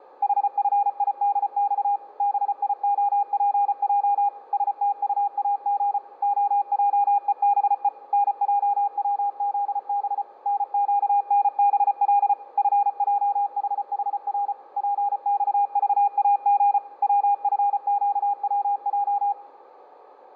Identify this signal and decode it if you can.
Morse code, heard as a keyed tone, machine-sent, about 34 wpm, 810 Hz, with radio static. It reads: HFIDX BIOPJ STUAG OJEBE NJWZB NQNBL FJHHR PXVAG WFQWJ